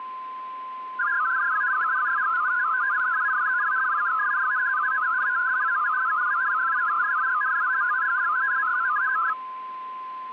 Multi-tone FSK (Olivia or MFSK type), about 500 Hz wide, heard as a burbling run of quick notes, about 62.5 baud, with static crashes and a steady whistle near 1030 Hz.